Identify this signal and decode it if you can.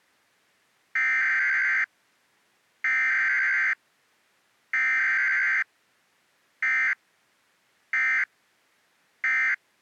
Emergency Alert System (SAME) tones (header bursts, then end-of-message bursts), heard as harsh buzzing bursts, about 520.83 baud.